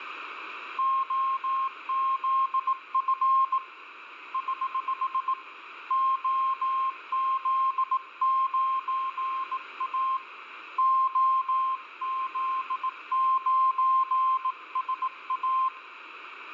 Morse code, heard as a keyed tone, hand-sent with a bug key, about 18 wpm, 1060 Hz, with radio static and a weaker station near 2080 Hz. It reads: OZF <HH> OZ9A OZ9SA